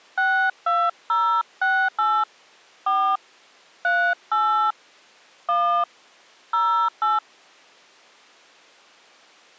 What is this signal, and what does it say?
DTMF, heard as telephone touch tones, dialled by hand, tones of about 280 ms. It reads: 62068 4 38 1 08